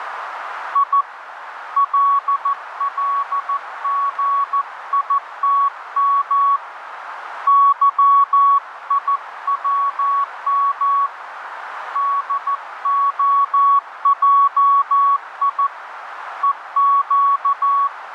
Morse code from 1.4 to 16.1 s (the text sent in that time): LLGITM YIWM DOJI